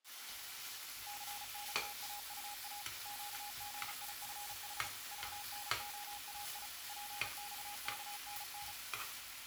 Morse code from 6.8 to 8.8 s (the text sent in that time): PXKNN